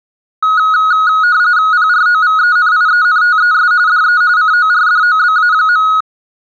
RTTY (45.45 baud, 170 Hz shift), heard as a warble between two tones, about 1360 Hz centre. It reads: PROVENIENTES DE CORDOBA.